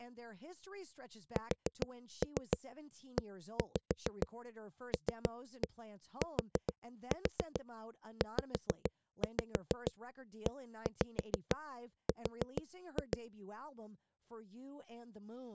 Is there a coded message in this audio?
Yes: tap code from 1.4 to 13.2 s, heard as knocks on a wall, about 6 knocks a second, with speech in English. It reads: SELTZER